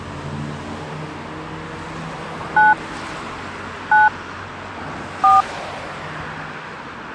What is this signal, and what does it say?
DTMF, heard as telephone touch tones, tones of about 170 ms, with street noise. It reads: 9 9 4